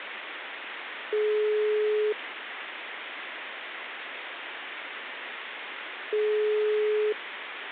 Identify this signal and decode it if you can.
Telephone call progress tone (single-tone plan, as in most of Europe), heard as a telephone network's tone, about 420 Hz, 1 s on and 4 s off, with phone line noise. Ringback tone.